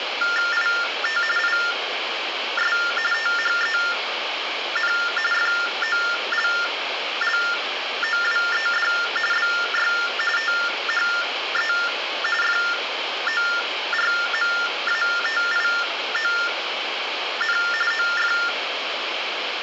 TTY/TDD text telephone tones (45.45 baud Baudot), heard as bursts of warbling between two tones, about 400 Hz shift, 1600 Hz centre, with phone line noise and room echo. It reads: IT IS THEN FOLLOWED BY THE FORMATION OF